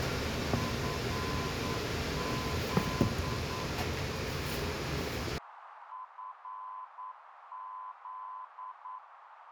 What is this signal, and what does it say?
Morse code, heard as a keyed tone, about 9 wpm, 1020 Hz, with radio static, a narrow filter and kitchen noise. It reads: FZ FZ